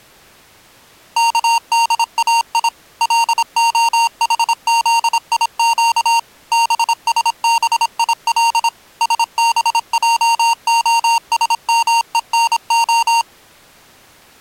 Morse code (Hebrew alphabet), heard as electronic beeps, machine-sent, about 26 wpm, 920 Hz. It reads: כדאי להחזיק בשביל שבעהשמונה